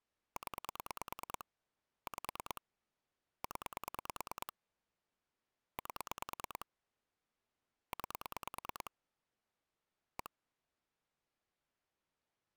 Pulse dialling, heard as clicks on a phone line, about 9 pulses a second. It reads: 0 5 0 8 9 1